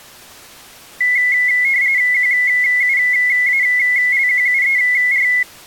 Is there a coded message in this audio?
Yes: RTTY (45.45 baud, 170 Hz shift) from 1.0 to 5.4 s, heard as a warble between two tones, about 2050 Hz centre. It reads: QUALQUER